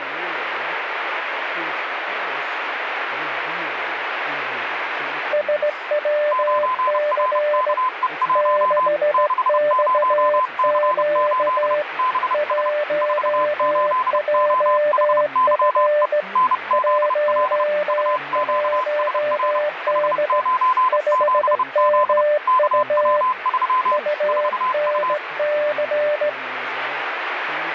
Morse code, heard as two keyed tones, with radio static and speech in English. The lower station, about 17 wpm, 600 Hz: SWC 6XQ 1JF 11D 5MU UNC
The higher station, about 30 wpm, 1020 Hz: 9RKE1 60C8 BS 48OHYE NZL UQSR H97Z KW3 4U